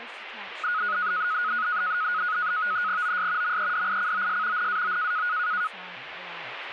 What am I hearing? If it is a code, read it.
NAVTEX (SITOR-B), 100 baud, 170 Hz shift, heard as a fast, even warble, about 1360 Hz centre, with radio static and speech in English. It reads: OS MEDICOS NAO